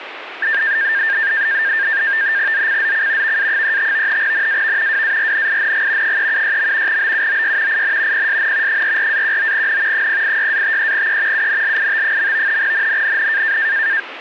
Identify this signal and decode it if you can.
NAVTEX (SITOR-B), 100 baud, 170 Hz shift, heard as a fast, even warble, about 1700 Hz centre, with radio static. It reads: ZCZC VA35 NAV WARNING 376. BUOY IN PSN 44-19N 086-53E UNLIT. NNNN